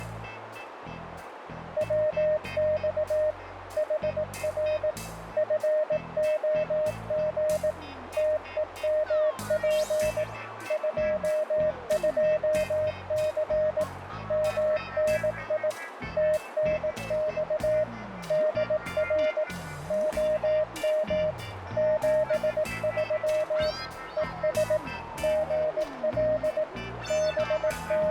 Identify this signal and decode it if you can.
Morse code, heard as a keyed tone, machine-sent, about 18 wpm, 620 Hz, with radio static and a narrow filter. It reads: WX HR FOG TEMP 22C MNI TNX DR OM 73 ES GL …